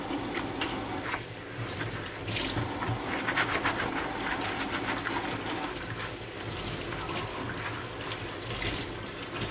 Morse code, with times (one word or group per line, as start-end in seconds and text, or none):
none